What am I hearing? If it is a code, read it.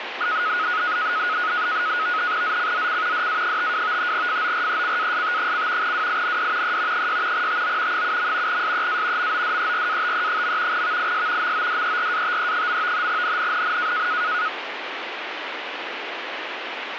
NAVTEX (SITOR-B), 100 baud, 170 Hz shift, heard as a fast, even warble, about 1360 Hz centre, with radio static. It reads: ZCZC DA52 FORECAST: WIND E 6 TO 7. SEA MODERATE. VIS MODERATE. NNNN